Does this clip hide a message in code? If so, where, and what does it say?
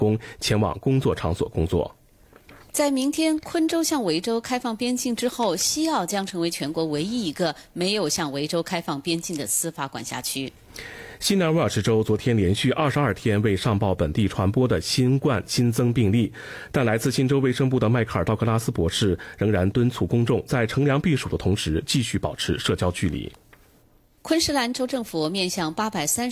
No.